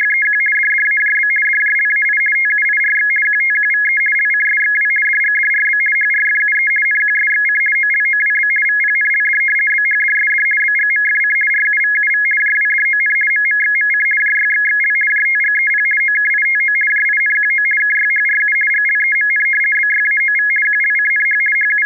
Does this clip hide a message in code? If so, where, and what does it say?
Yes: RTTY (50 baud, 450 Hz shift) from 0.0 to 21.9 s, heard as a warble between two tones, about 1900 Hz centre. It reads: … DDAJB DJLAI TUIRX QTQVE LCSXW DGDRB HRFUE NQSXC OLOWB VPNLD BHDSD BGMFC RUVUV JWDON MMXMC JYXXL JTGEP OKITO JINQO KYHRU GLEMN BYAOV QLCNH …